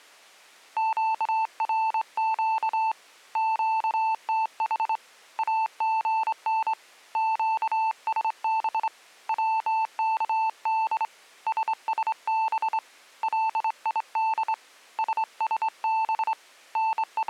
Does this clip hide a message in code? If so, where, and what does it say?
Yes: Morse code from 0.7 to 17.3 s, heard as a keyed tone, hand-sent with a straight key, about 25 wpm, 890 Hz. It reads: QRQ QTH AGN QSB WKD SSB LID SSB …